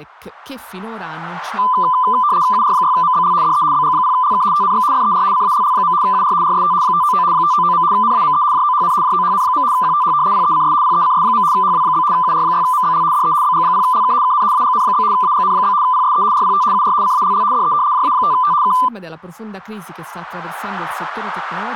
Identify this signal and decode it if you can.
RTTY (75 baud, 170 Hz shift), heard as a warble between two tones, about 1100 Hz centre, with speech in Italian. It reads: UR6MBL DE BG0LK TNX FER CALL. UR RST 599 599. NAME JOHN JOHN. QTH PECS PECS. HW? UR6MBL DE BG0LK KN AGN? AGN? PSE RPT UR CALL DE JA5T K